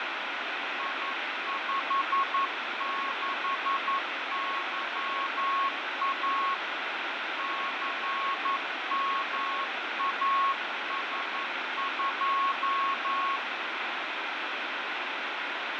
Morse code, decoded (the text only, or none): I56YA CMAS2